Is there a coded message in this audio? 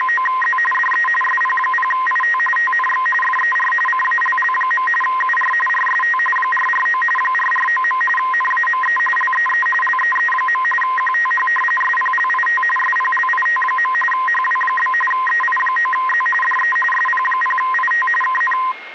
Yes: RTTY (45.45 baud, 850 Hz shift) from 0.0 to 18.7 s, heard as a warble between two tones, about 1460 Hz centre, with radio static and a steady whistle near 2140 Hz. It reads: … DE SP0IT TNX FER CALL. UR RST 449 449. NAME LEE LEE. QTH SPLIT SPLIT. HW? EI9Z DE SP0IT KN